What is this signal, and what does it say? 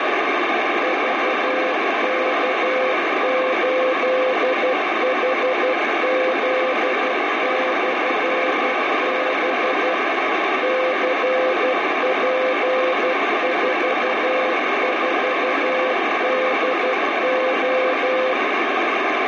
Morse code, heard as a keyed tone, machine-sent, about 12 wpm, 520 Hz, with heavy radio static. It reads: VK8HZ/B CP44DO